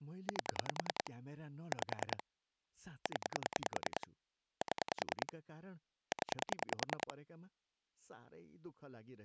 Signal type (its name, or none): pulse dialling